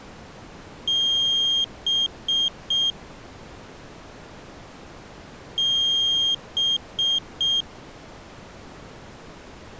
Beep code, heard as a piezo beeper, played twice, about 3200 Hz. 1 long, 3 short. In Award and IBM BIOS tables: video adapter failure; in AMI BIOS tables: memory failure.